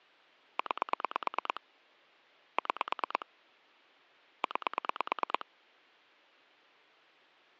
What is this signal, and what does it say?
Pulse dialling, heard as clicks on a phone line, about 9 pulses a second. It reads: 9 6 9